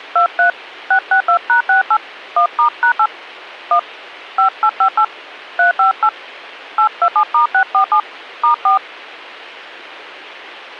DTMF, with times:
0.2-0.5 23
0.9-2.0 662#68
2.4-3.1 1*#8
3.7-3.8 1
4.4-5.0 5858
5.6-6.1 358
6.8-8.0 827*647
8.4-8.8 *4

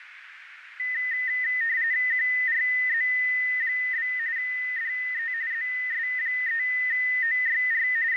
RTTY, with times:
2.1-4.1 QRZ?
4.4-5.3 DE
5.5-7.9 ZS3OYR
8.1-8.2 …

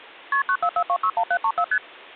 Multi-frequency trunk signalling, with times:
0.3-0.4 KP
0.5-1.6 944261734
1.7-1.8 ST

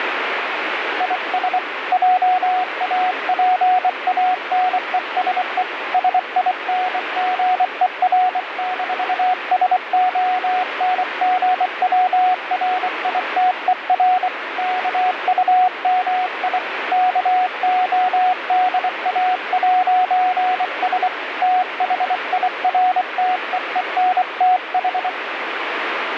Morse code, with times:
1.0-1.6 IS
1.9-5.6 JAPANESE
5.9-14.3 SINGER-SONGWRITER
14.6-16.6 KUMI
16.9-21.1 KODA'S
21.4-25.1 THIRTEENTH

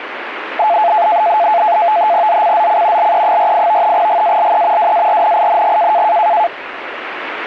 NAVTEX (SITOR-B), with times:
2.3-3.1 ZCZC
3.0-3.9 LE48
3.9-4.9 GALE
4.8-6.0 WARNING

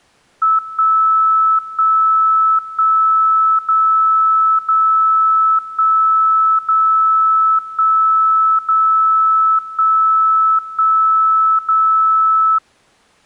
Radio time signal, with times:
0.6-1.6 1
1.6-2.6 1
2.6-3.6 1
3.6-4.6 0
4.6-5.6 0
5.6-6.6 1
6.6-7.6 0
7.6-8.6 1
8.6-9.6 0
9.6-10.6 1
10.6-11.6 1
11.6-12.6 0

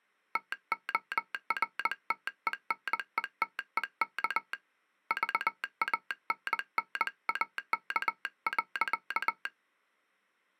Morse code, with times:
0.4-4.5 TORTENETEK
5.1-9.5 VANNAK.

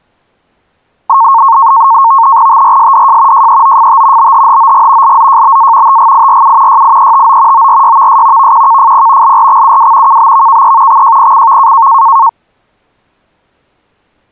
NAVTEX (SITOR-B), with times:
2.5-3.5 TRSDJ
3.3-4.3 JEOFT
4.2-5.2 BHHOG
5.0-6.0 LZJBA
5.9-6.8 TGIRU
6.7-7.7 YIETO
7.5-8.5 ORYVS
8.4-9.4 VQKFP
9.2-10.2 LRXUW
10.1-11.0 KBVKE
10.9-11.9 XJPCV

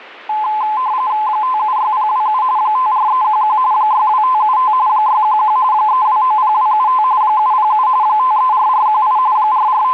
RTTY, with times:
1.3-2.4 576027
2.6-3.6 54311
3.7-4.7 62575
4.9-5.6 611
5.7-7.0 3290275
7.2-7.9 707
8.0-9.2 534418
9.4-9.9 …

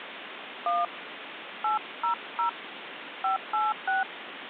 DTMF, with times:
0.7-0.8 1
1.6-2.5 800
3.2-4.0 586

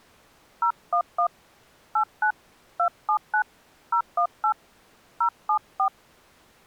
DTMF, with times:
0.6-1.3 011
2.0-2.3 89
2.8-3.4 279
3.9-4.5 018
5.2-5.9 074

